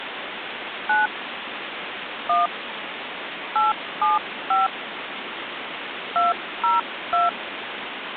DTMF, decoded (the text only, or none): 9 1 875 202